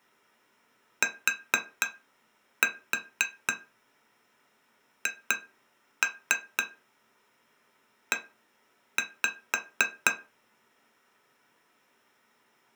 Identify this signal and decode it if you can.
Tap code, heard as taps on glass, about 4 knocks a second. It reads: THE